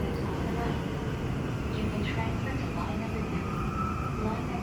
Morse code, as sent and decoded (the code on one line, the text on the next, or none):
none